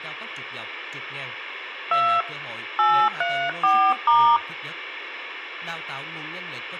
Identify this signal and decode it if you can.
DTMF, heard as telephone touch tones, dialled by hand, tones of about 290 ms, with speech in Vietnamese. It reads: 2 834*